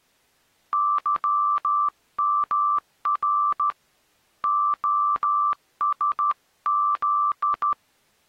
Morse code, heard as a keyed tone, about 13 wpm, 1170 Hz. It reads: YMR OSZ